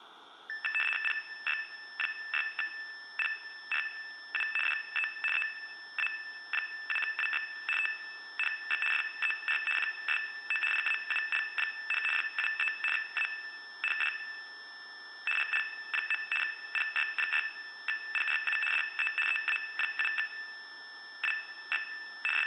RTTY (75 baud, 850 Hz shift), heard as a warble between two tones, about 2200 Hz centre, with room echo. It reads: PY6PRU DE EA7WX TNX FER QSO PAUL, 73 AND GL. PY6PRU DE EA7WX …